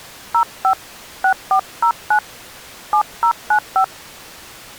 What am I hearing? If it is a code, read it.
DTMF, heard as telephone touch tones, dialled by hand, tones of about 80 ms. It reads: 05 6409 7095